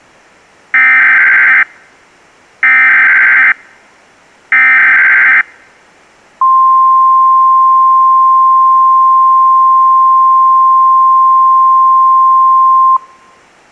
Emergency Alert System (SAME) tones (header bursts, then the 1050 Hz attention tone), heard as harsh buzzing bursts, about 520.83 baud.